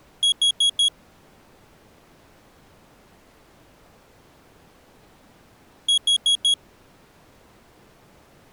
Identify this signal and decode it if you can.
Alarm pattern, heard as an alarm's beeps, played twice, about 3300 Hz. Temporal four. Carbon monoxide.